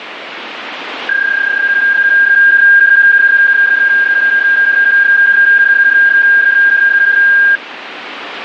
PSK31 (31.25 baud), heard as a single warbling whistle, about 1600 Hz, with radio static.